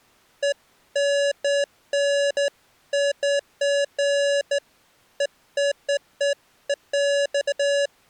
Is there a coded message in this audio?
No, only beeps of irregular length.